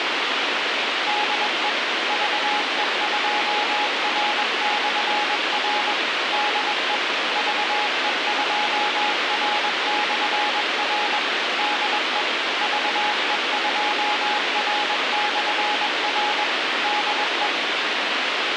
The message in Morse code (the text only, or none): DE VE2R/R DE VE2R/R DE VE2R/R DE